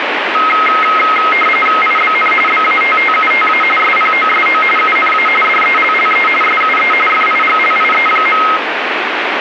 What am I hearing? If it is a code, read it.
RTTY (45.45 baud, 850 Hz shift), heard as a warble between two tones, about 1700 Hz centre, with radio static. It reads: IBN BATTUTA SPOSO UNA DELLE SUE FIGLIE.